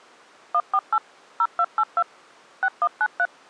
DTMF, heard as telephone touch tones, dialled by machine, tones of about 60 ms. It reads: 148 0282 6193